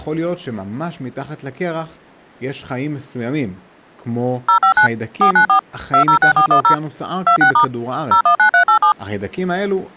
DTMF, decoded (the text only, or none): 059 494 206410 26* 019387